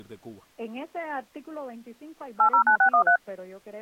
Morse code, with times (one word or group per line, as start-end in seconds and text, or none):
none